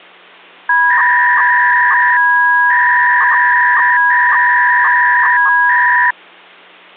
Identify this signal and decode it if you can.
300-baud modem data (V.21 tones), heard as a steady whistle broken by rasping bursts, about 300 baud, 200 Hz shift.